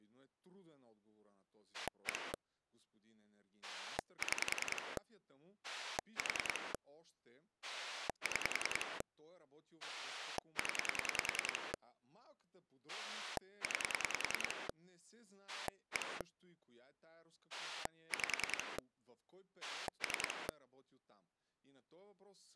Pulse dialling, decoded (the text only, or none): 1 6 4 6 0 9 1 5 3